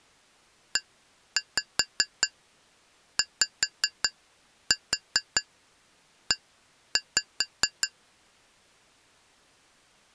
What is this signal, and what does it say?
Tap code, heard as taps on glass, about 5 knocks a second. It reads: EYE